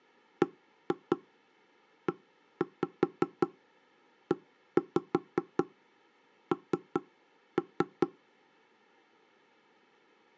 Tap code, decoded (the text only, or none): BEEN